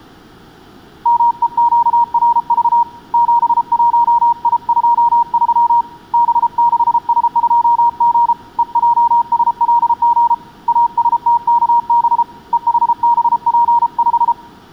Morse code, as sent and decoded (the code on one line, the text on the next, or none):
-- . --.- .-. ...- / --... .---- .. ..--- ...-- / -... -.... ... ..--- --. / . .--- ... .-.. --. / .- ... - -.- -... / . .... -... .--. .....
MEQRV 71I23 B6S2G EJSLG ASTKB EHBP5